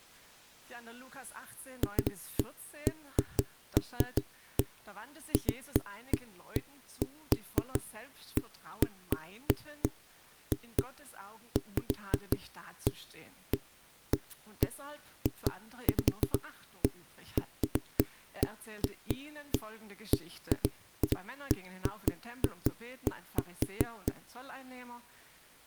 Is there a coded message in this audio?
No, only irregular knocks on a wall.